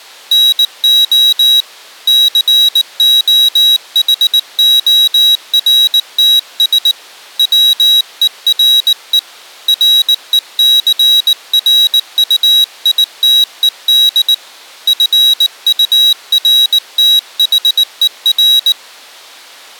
Morse code, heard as a high beeper, hand-sent with a paddle, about 19 wpm, 3850 Hz. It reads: NO COHORTS WERE RECRUITED FURTHER